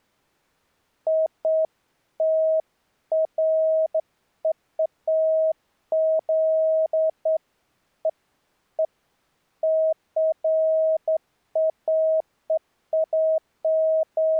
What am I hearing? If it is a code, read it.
Beeps of irregular length. There is no code.